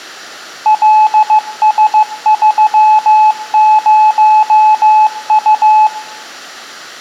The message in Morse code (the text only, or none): LS30U